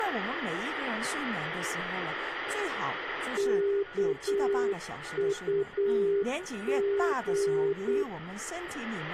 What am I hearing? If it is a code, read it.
Morse code, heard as a keyed tone, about 8 wpm, 400 Hz, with radio static, a weaker station near 1450 Hz, room echo and speech in Chinese. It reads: KUG